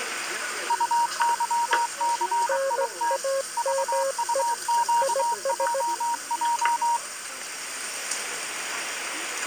Morse code, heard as two keyed tones, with the noise of a restaurant. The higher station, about 23 wpm, 940 Hz: UYCIT VUQJJ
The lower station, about 17 wpm, 540 Hz: NAME IS